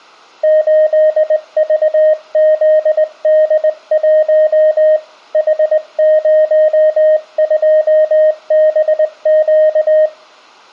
Morse code, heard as a keyed tone, hand-sent with a straight key, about 20 wpm, 620 Hz, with room echo. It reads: 8VZD1 H02BQ